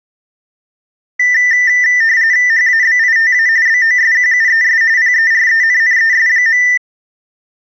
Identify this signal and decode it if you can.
RTTY (45.45 baud, 170 Hz shift), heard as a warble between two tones, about 1900 Hz centre. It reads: HABITA BOSQUES PERENNES.